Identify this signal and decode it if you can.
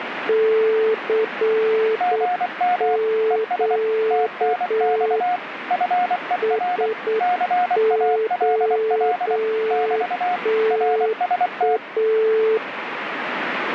Morse code, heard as two keyed tones, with radio static. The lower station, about 8 wpm, 440 Hz: CQ SOTA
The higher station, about 24 wpm, 720 Hz: GM ES TNX FER CALL <BT> RST